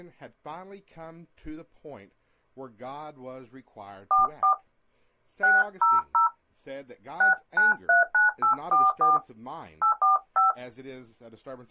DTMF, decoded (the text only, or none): 44 600 6939844 845